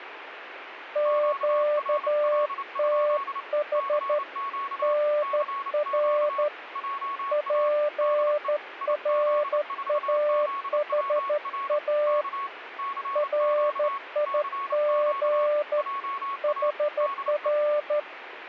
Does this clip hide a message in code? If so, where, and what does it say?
Yes: Morse code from 0.9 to 18.1 s, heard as two keyed tones, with radio static. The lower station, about 13 wpm, 590 Hz: QTH NR PRAHA RIG HR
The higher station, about 29 wpm, 1110 Hz: QRL? CQ CQ JA DE IZ4ZWR K CQ CQ JA DE